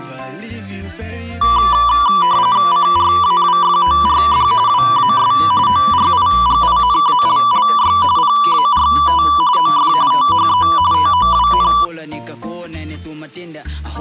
RTTY (45.45 baud, 170 Hz shift), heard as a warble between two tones, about 1080 Hz centre. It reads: CRAWFORD WAS ORIGINALLY PART OF THE TOWN